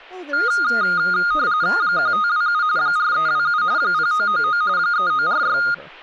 RTTY (45.45 baud, 170 Hz shift), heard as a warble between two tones, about 1330 Hz centre, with speech in English. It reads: 1527 4327 0999 3946